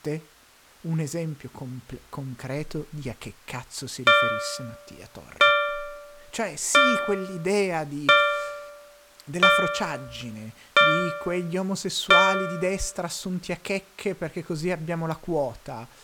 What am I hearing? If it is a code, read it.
Clock strike, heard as a bell, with speech in Italian. 7. Seven o'clock.